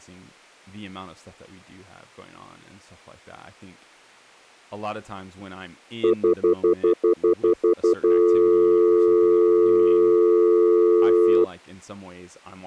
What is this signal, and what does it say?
Telephone call progress tone (North American plan), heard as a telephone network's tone, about 350, 440 Hz, 0.1 s on and 0.1 s off, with speech in English. Stutter dial tone.